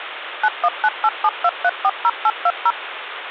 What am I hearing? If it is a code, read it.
DTMF, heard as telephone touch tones, dialled by machine, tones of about 50 ms, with phone line noise. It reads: 919872340820